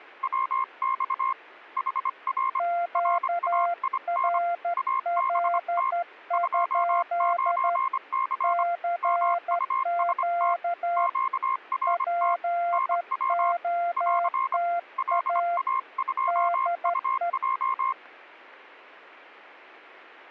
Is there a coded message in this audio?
Yes: Morse code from 0.2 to 18.0 s, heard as two keyed tones. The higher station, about 25 wpm, 1060 Hz: WX HR RAIN ABT 29C MUST QRT NW <AR> LA2UJ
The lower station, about 12 wpm, 690 Hz: QRL? CQ POTA DE